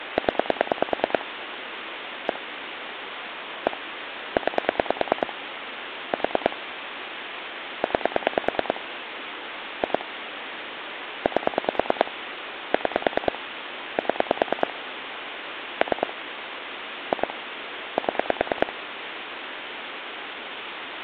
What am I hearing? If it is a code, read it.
Pulse dialling, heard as clicks on a phone line, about 9 pulses a second, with phone line noise. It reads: 0 1 1 9 4 9 2 8 6 7 3 2 7